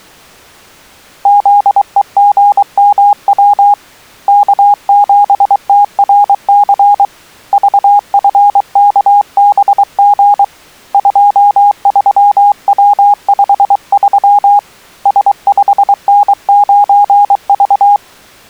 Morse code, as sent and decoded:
--.. . --. -- .-- / -.- --... - .-. -.-. / ...- ..-. -.- -... --. / ..--- ...-- .-- ..... ...-- / ... ..... -. ----. ...-
ZEGMW K7TRC VFKBG 23W53 S5N9V

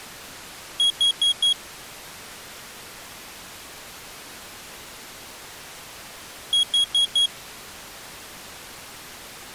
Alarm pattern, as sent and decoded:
4 beeps and a pause
temporal four

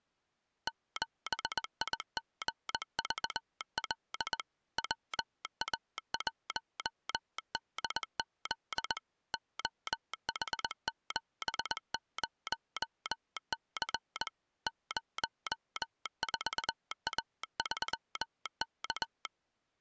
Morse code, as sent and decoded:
--... .. --. ...- .-.. / .-- .- .---- -.. --.. / --- .... --... ----- -.-. / ----- ....- .- ...-- -.-
7IGVL WA1DZ OH70C 04A3K

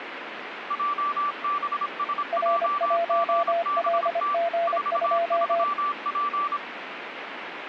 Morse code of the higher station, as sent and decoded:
.--- -... ... .--- --. -... - / ....- ...-- .--.
JBSJGBT 43P

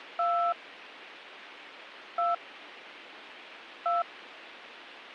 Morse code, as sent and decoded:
none

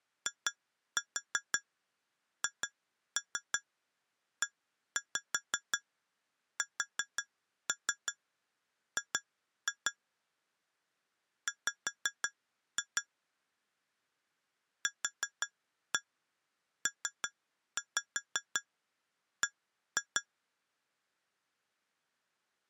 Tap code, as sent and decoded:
2-4 2-3 1-5 4-3 2-2 / 5-2 / 4-1 3-5 1-2
IHESG W QPB

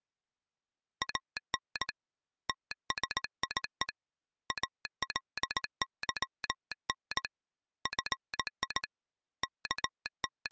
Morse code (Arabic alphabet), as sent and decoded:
.- -. / - ... .. . / .- .-.. -.-- -. / ..-. .. / …
ان تسيء الظن في …

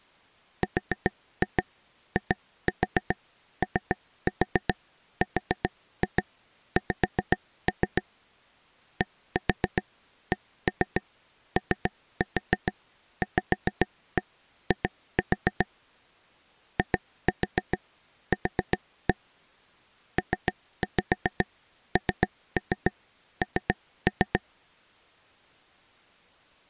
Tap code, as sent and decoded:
4-2 2-4 3-4 4-2 5-3 / 1-4 1-3 3-4 5-1 2-4 / 2-4 4-1 / 3-5 3-3 3-3
RIORX DCOVI IQ PNN

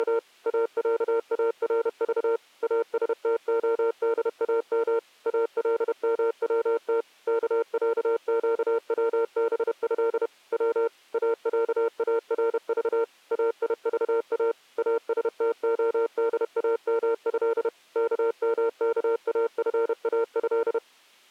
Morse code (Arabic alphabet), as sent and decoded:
… / .- .-.- .- .-. ...- / .- ... - --- -.. .- -- / .- .-.. -- .-- - / -.- .-.- --.- .-- -... ..-.. / .-- / .- .-.- .- .-. ...- / .- .. ...- .- / .- ... - --- -.. .- -- ..-.. / -.- -- -.- .- ..-. .- ..-..
… اعارض استخدام الموت كعقوبه و اعارض ايضا استخدامه كمكافاه

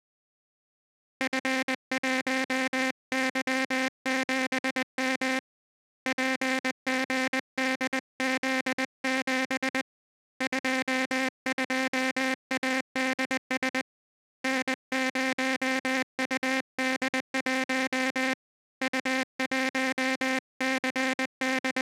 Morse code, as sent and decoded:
..-. .---- -.-- --... -- / .--. --. -.. --.. --... / ..--- ..--- .- -.. ... / -. ----- ..- -.. .---- / …
F1Y7M PGDZ7 22ADS N0UD1 …

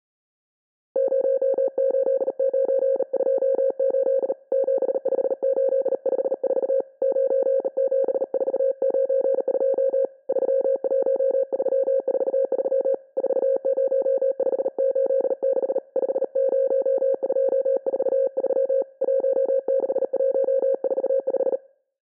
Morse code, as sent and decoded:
----- ---.. ----. ..--- ---.. / --... ..... ---.. ..... ....- / ----. --... ....- ----. ..--- / ...-- .---- ...-- ....- ...-- / ....- ----- ..... ---.. -.... / ..... ----- ..--- ....- ...-- / .---- -.... .---- ....- .....
08928 75854 97492 31343 40586 50243 16145

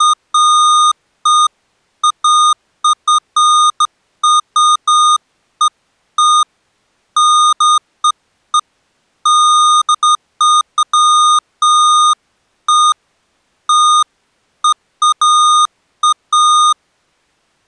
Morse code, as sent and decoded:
none

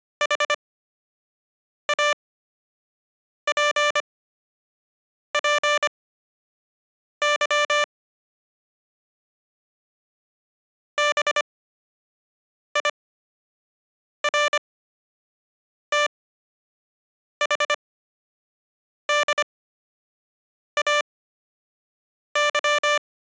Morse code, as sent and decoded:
.... .- .--. .--. -.-- / -... .. .-. - .... -.. .- -.--
HAPPY BIRTHDAY

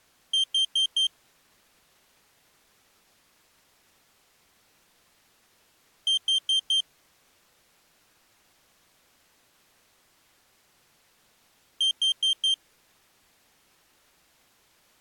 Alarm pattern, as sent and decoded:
4 beeps and a pause
temporal four

